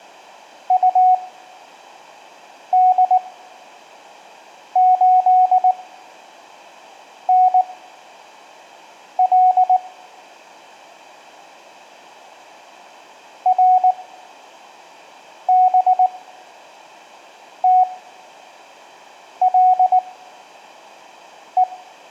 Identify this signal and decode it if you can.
Morse code, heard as a keyed tone, machine-sent, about 19 wpm, spaced as for 5 wpm, 740 Hz, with room echo. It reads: UD8NL RBTLE